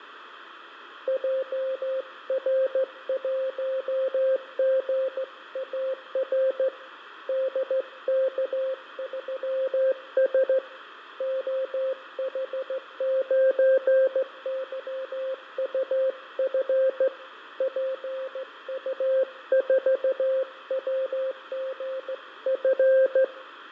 Morse code, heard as a keyed tone, hand-sent with a straight key, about 15 wpm, 530 Hz, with radio static, fading and room echo. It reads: JR1GAR DK3S OH9YUF PU4WGF